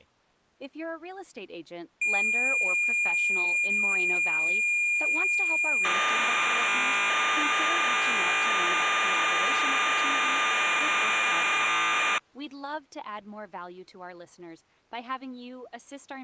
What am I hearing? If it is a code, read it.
Cassette data (Kansas City type), 1200 baud, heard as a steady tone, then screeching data, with speech in English.